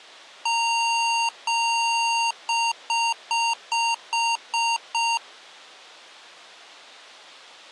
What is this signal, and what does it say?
Beep code, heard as beeps from a small speaker, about 930 Hz. 2 long, 7 short.